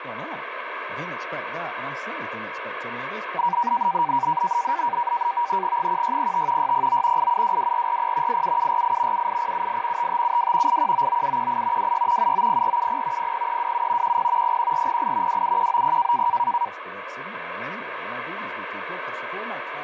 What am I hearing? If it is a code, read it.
NAVTEX (SITOR-B), 100 baud, 170 Hz shift, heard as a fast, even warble, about 870 Hz centre, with radio static and speech in English. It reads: 1605 609 8722440 87748 78078 5572 8199718 26 790470 00327 10 01408 27190